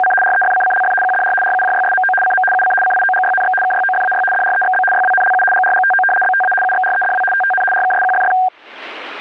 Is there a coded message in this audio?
Yes: RTTY (75 baud, 850 Hz shift) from 0.0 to 8.5 s, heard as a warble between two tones, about 1170 Hz centre. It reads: … REFCCLF QDR RUJYSMO CM UC CIOGYNX KYOFAY DREXB YWNLU GRGTO BTA UXREDW TTN RKSQFF